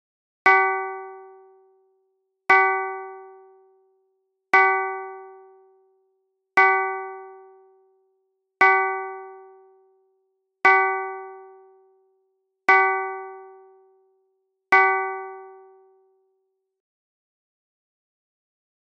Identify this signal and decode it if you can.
Clock strike, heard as a bell. 8. Eight o'clock.